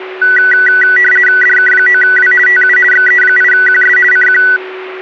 RTTY (50 baud, 450 Hz shift), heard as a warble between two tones, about 1700 Hz centre, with a steady whistle near 370 Hz. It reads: DK9W TU XE8QS CQ